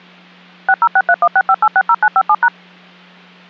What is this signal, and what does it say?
DTMF, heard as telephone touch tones, dialled by machine, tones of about 60 ms, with hum. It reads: 6063165860957#